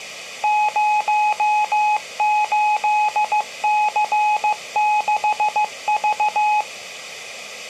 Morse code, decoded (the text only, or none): 08C6V